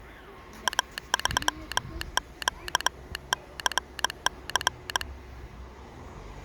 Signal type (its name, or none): Morse code